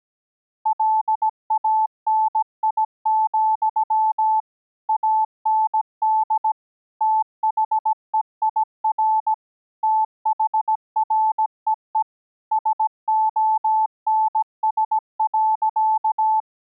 Morse code, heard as a keyed tone, machine-sent, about 17 wpm, 870 Hz. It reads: LANI, AND THEIR THREE SONS.